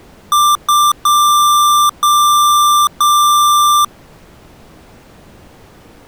Beep code, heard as beeps from a small speaker, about 1180 Hz. 2 short, 3 long.